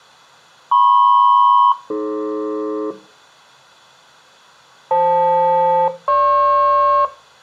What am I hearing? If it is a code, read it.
Aircraft SELCAL, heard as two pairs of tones, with room echo. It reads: MP-AD FL-GP